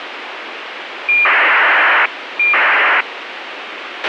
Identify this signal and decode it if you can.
ACARS aircraft data, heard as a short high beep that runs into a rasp, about 2400 baud, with radio hiss and a squelch burst at the end.